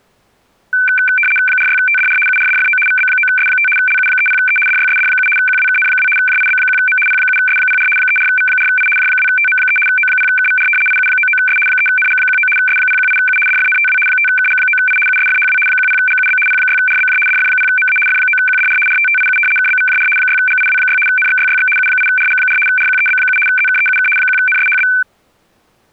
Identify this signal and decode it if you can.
RTTY (75 baud, 850 Hz shift), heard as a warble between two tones, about 1950 Hz centre. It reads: 46TDR URDFO VB9S5 LU30E DYSD7 QWKN2 JIB1M P7S04 34V4I J2TM3 O0KVR IU99S 3NG19 S018U DFNTW 5KG9I USFHW 10GUB P6RBJ DF0MA F9QDR RTTIU KBVJR 6GIW6 NXYYX U8RG4 RQEB7 ZKEUK 1NSHB